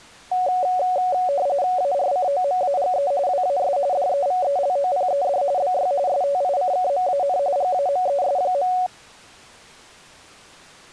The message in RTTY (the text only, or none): ARCOMAGE WAS DEVELOPED BY STICKMAN GAMES.